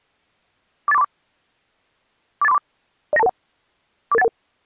Five-tone selective call (EIA), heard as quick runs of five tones, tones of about 30 ms. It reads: 48434 48434 09221 44811